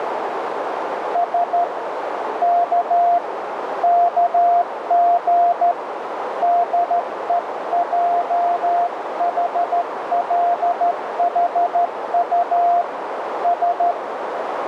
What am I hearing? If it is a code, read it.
Morse code (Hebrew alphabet), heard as a keyed tone, hand-sent with a straight key, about 13 wpm, 700 Hz, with radio static and a narrow filter. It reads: ש כ כג דועחלחט ש